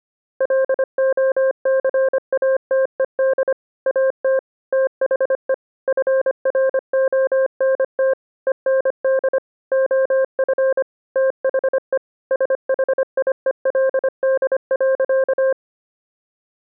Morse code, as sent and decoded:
.-.. --- -.-. .- - . -.. / .- - / - .... . / ..-. .-. --- -. - / . -. -.. / --- ..-. / - .... . / ... .... .. . .-.. -.. .-.-.-
LOCATED AT THE FRONT END OF THE SHIELD.

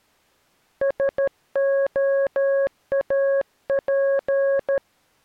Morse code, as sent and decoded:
... --- .- .--.
SOAP

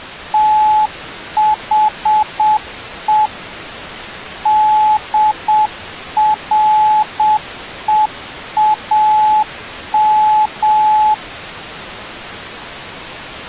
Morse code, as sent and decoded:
- .... . / -.. .-. . .- --
THE DREAM

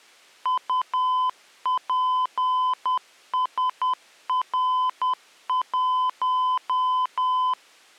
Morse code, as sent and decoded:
..- .--. ... .-. .----
UPSR1

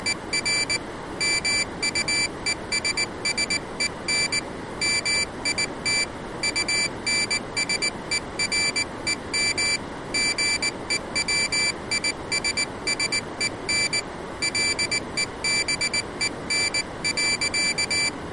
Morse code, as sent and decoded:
… / -- ..- . ... ... . -. / -- .. - / ..- -. ... . .-. . -- / --. . .-- .. ... ... . -. / .-.. . -... . -. .-.-.-
… MUESSEN MIT UNSEREM GEWISSEN LEBEN.

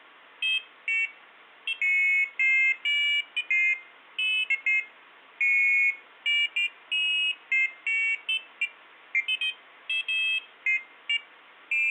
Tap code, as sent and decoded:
none

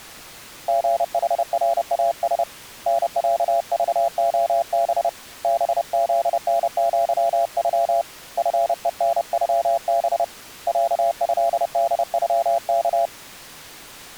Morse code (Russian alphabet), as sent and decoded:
--. .... .-. .- ... / -. .-.- ...- --- -... / -... --.. -. --.-- ..-- / ..-. . -. ..-- -... / .-.- ..-.. -.. ..-- -.-
ГХРАС НЯЖОБ БЗНЪЮ ФЕНЮБ ЯЭДЮК

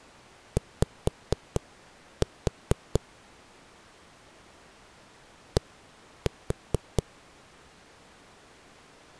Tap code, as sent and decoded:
5-4 / 1-4
Y D

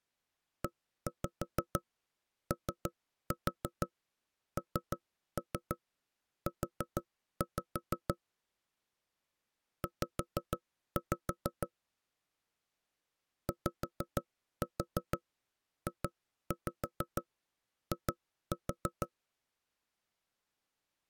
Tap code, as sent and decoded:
1-5 3-4 3-3 4-5 / 5-5 / 5-4 2-5 2-4
EONU Z YJI

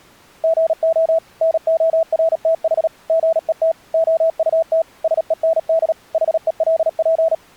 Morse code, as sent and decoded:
--. --- / -. --- .-. - .... / --. . - / --- ..- - / ... . -. -.. / .... . .-.. .--.
GO NORTH GET OUT SEND HELP

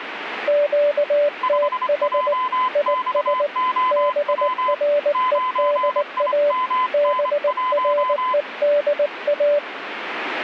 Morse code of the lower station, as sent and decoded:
--.- - .... / .. ... / -... .-. . -.. .- / -... .-. . -.. .-
QTH IS BREDA BREDA

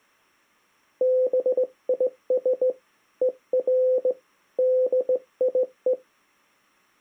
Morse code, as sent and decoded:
-... .. ... / . .-. / -.. .. .
BIS ER DIE

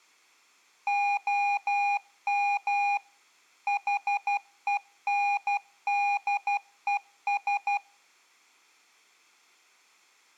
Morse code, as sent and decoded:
--- -- / .... . -. -.. . ...
OM HENDES

